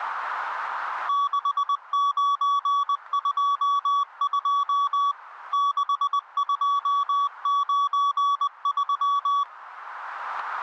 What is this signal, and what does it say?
Morse code, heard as a keyed tone, machine-sent, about 20 wpm, 1140 Hz, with radio static. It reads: 6922 6293